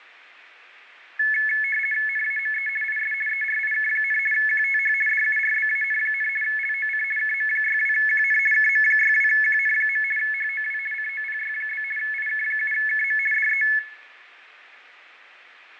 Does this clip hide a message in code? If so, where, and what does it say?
Yes: RTTY (50 baud, 450 Hz shift) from 1.2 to 13.8 s, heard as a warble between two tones, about 1950 Hz centre, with radio static, fading and room echo. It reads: NAME IS ERIK, QTH DURBAN, LOC KM62QN KM62QN. HOW COPY? IK7KM DE